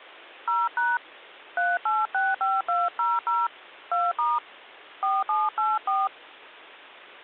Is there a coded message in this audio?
Yes: DTMF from 0.5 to 6.1 s, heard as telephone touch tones, dialled by hand, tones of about 200 ms. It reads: 0# 3865200 2* 4784